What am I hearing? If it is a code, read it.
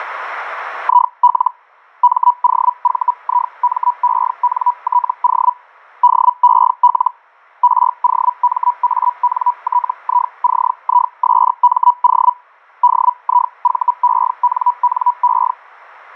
Hellschreiber (Feld-Hell, 122.5 baud), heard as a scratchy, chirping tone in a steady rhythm, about 980 Hz. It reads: IL MOVIMENTO DEL ROMANTICISMO DIVENNE